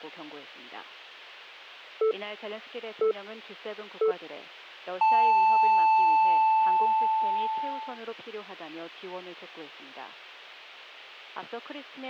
Radio time signal (three low pips and a long one an octave up, as on NHK), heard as pips.